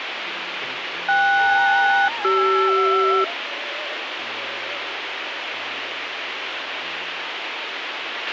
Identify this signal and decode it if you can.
Aircraft SELCAL, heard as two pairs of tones, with radio hiss and a squelch burst at the end. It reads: KS-CR